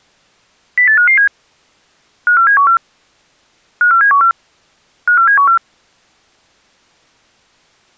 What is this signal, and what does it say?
Five-tone selective call (CCIR), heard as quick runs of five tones, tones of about 100 ms. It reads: 08557 54714 54714 54714